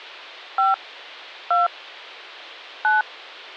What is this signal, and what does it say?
DTMF, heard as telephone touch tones, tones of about 160 ms. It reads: 5 2 9